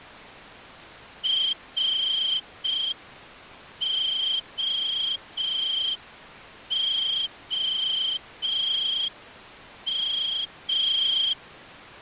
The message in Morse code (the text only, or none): ROOM